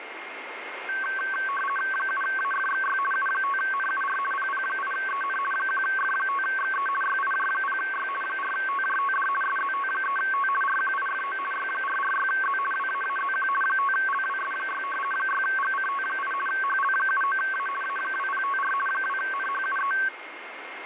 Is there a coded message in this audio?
Yes: RTTY (50 baud, 450 Hz shift) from 0.9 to 20.1 s, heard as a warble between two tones, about 1330 Hz centre, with radio static and a steady whistle near 2130 Hz. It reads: 7AFXY U5NUR PP8EN 1F5XE YIJ0Y 4TJTD SZT3T RQIFO Y446Z WAAZQ 5LWS6 6GCT8 HL79A A2054 2NHUE